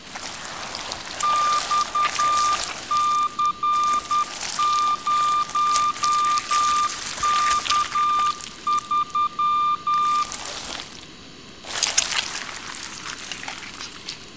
Morse code, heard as a keyed tone, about 10 wpm, 1200 Hz, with room echo. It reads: XC0K3